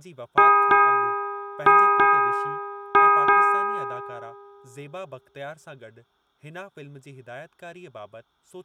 Ship's bell, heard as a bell, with room echo and speech in Sindhi. 6. Six half-hours of the watch have passed.